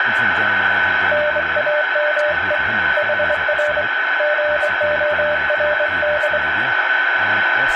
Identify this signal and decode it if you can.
Morse code, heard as a keyed tone, hand-sent with a straight key, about 24 wpm, 600 Hz, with radio static, a steady whistle near 1510 Hz, room echo and speech in English. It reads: NAME HR GORD